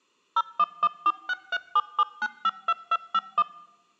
DTMF, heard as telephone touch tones, dialled by machine, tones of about 50 ms. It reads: 01146377952251